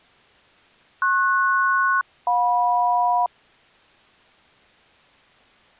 Aircraft SELCAL, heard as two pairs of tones. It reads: PS-JM